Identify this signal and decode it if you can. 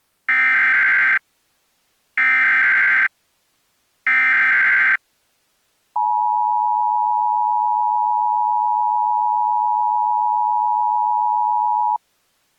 Emergency Alert System (SAME) tones (header bursts, then the 853 and 960 Hz attention tone), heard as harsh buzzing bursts, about 520.83 baud.